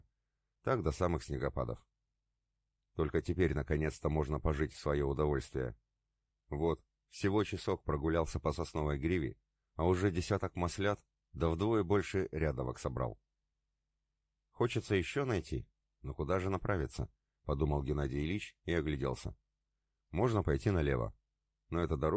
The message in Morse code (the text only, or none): none